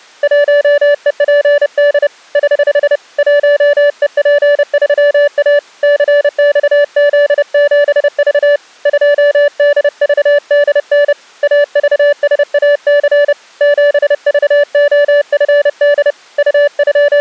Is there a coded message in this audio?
Yes: Morse code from 0.2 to 17.2 s, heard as a keyed tone, hand-sent with a paddle, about 30 wpm, 580 Hz. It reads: 1EPD <HH> 1EP3A CXZ7V 2DVDN AVSAC 7VOFD …